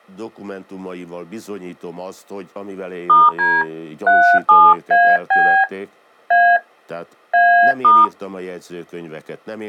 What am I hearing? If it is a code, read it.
DTMF, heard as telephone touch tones, dialled by hand, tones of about 280 ms, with speech in Hungarian. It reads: *D 37AB A A*